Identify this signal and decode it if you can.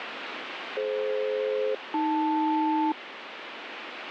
Aircraft SELCAL, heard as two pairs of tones, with radio static. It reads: DF-AL